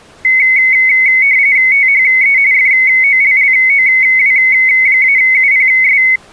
RTTY (45.45 baud, 170 Hz shift), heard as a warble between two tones, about 2150 Hz centre. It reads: THE FOLLOW-UPS